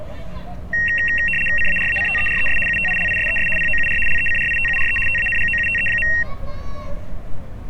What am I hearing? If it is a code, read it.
RTTY (75 baud, 850 Hz shift), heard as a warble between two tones, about 2300 Hz centre, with street noise. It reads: CARACTERES UTILISES POUR LECRITURE TANGOUTE.